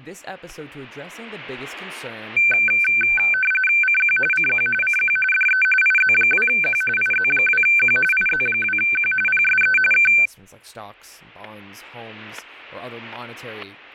RTTY (45.45 baud, 850 Hz shift), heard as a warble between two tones, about 1950 Hz centre, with static crashes and speech in English. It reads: CQ CQ CQ DE IZ2Q IZ2Q IZ2Q PSE K